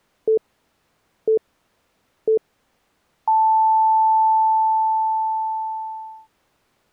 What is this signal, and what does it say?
Radio time signal (three low pips and a long one an octave up, as on NHK), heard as pips.